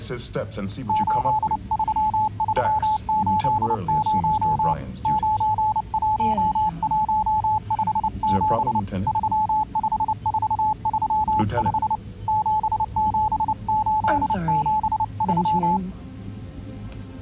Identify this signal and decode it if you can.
Morse code, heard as a keyed tone, hand-sent with a paddle, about 29 wpm, 860 Hz. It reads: 83380 91157 35435 77873